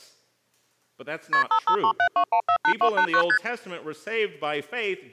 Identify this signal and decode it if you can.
Multi-frequency trunk signalling (R1, as on North American trunks), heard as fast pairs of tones, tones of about 80 ms. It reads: KP 55372148289 ST